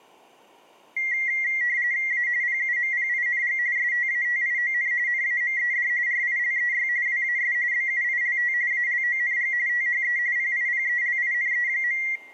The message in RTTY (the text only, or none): A PUMPING STATION NAMED RILEY WAS BUILT ALONG THE PIPELINE.